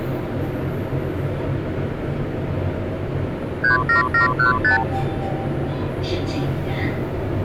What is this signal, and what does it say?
Multi-frequency trunk signalling (R2, with the far end's replies), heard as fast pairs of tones, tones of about 130 ms, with the noise inside a lift. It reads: 37715